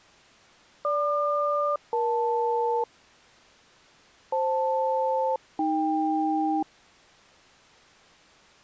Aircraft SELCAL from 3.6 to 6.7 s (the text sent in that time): FL-AK